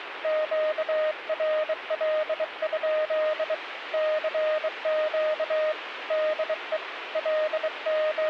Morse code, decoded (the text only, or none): QRL? CQ DE …